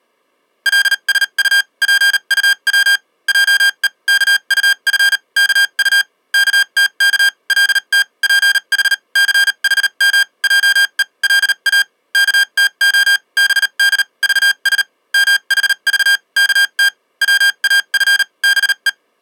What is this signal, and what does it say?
Morse code (Korean alphabet), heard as electronic beeps, machine-sent, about 38 wpm, spaced as for 32 wpm, 1600 Hz. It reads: 계집 하인이 엉거주춤하고 엎드려 물어 본다